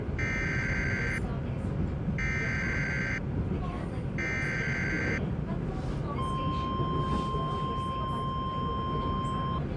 Emergency Alert System (SAME) tones (header bursts, then the 1050 Hz attention tone), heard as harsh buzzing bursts, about 520.83 baud, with the noise inside a subway train.